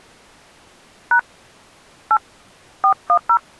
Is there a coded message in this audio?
Yes: DTMF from 1.1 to 3.4 s, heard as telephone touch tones, dialled by hand, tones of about 80 ms. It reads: # 8 410